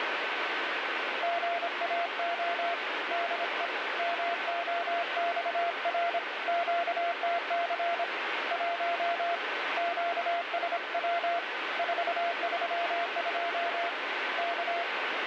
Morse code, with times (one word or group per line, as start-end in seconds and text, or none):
1.2-2.7 GAO
3.1-3.7 DE
4.0-6.2 MOXR
6.5-8.0 QTC
8.5-9.3 1
9.8-11.4 QSW
11.8-13.9 432
14.4-14.8 K